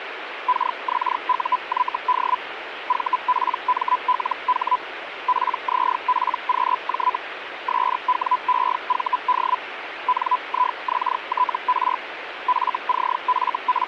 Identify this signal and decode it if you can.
Hellschreiber (Feld-Hell, 122.5 baud), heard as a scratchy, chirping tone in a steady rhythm, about 1000 Hz, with radio static. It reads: KXUYD VPMLH PZPQJ SWEVD NIXTR …